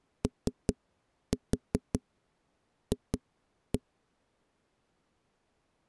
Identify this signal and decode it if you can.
Tap code, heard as knocks on a wall, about 5 knocks a second. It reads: OF